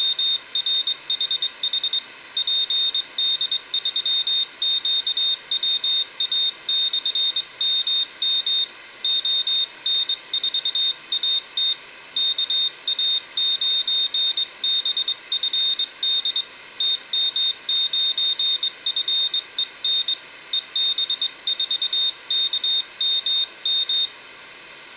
Morse code, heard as a high beeper, hand-sent with a straight key, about 22 wpm, 3650 Hz. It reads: … PD3QWA/MM ON4AT KA9BFD TM9FEN EB4KMM